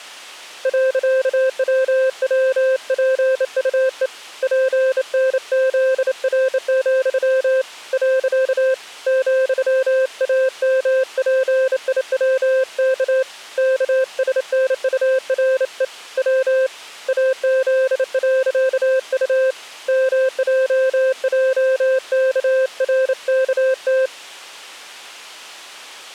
Morse code, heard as a keyed tone, hand-sent with a bug key, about 28 wpm, 520 Hz. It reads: .WWPUE PNZR, . ,AMPIWK KSNURE W AZ.U MJJKRKT